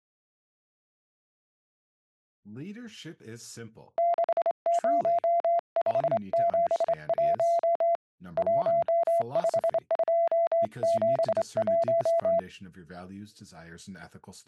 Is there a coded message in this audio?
Yes: Morse code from 3.9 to 12.5 s, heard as a keyed tone, hand-sent with a straight key, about 26 wpm, 680 Hz, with speech in English. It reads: 60571 15271